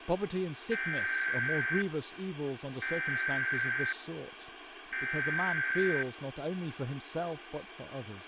Emergency Alert System (SAME) tones (header bursts), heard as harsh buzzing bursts, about 520.83 baud, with radio hiss and speech in English.